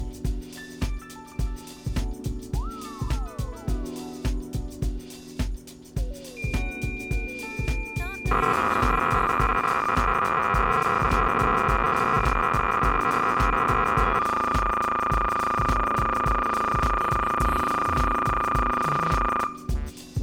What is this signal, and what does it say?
Cassette data (Kansas City type), 300 baud, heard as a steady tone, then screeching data.